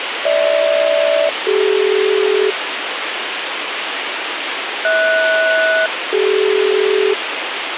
Aircraft SELCAL, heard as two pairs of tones, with radio hiss and a squelch burst at the end. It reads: GH-CD HS-CD